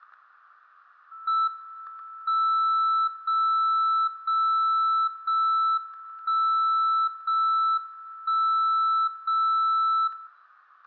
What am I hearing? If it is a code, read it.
Radio time signal (JJY), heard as a tone whose level steps once a second, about 1320 Hz, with static crashes and room echo. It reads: M 0 0 0 1 0 1 0 0